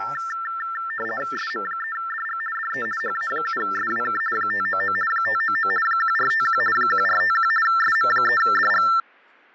RTTY (50 baud, 450 Hz shift), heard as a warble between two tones, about 1550 Hz centre, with fading and speech in English. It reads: SM3DG DE HA7SWK 599 599 1451 1451 SM3DG